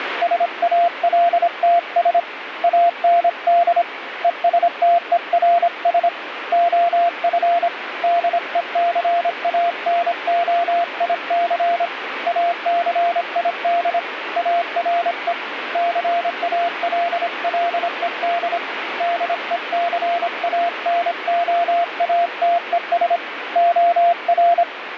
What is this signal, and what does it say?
Morse code, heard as a keyed tone, hand-sent with a paddle, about 26 wpm, 690 Hz, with radio static. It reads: SALTS AND ESTERS OF DECANOIC ACID ARE CALLED DECANOATES OR